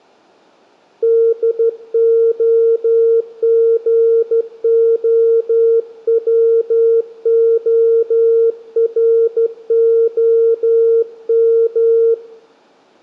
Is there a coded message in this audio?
Yes: Morse code (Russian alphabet) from 1.0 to 12.2 s, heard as a keyed tone, hand-sent with a straight key, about 13 wpm, 460 Hz, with room echo. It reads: ДОГОВОРОМ